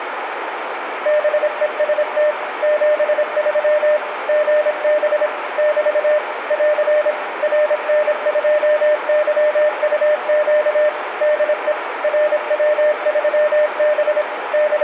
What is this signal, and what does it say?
Morse code, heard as a keyed tone, machine-sent, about 26 wpm, 600 Hz, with radio static, a narrow filter and room echo. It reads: BEST 73 GB <BT> <AR> RN2YUQ DE RW3B …